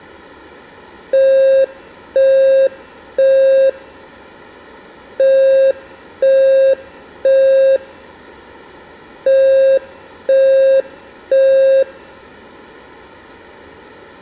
Alarm pattern, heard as an alarm's beeps, played three times, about 540 Hz. Temporal three. Smoke or fire, evacuate.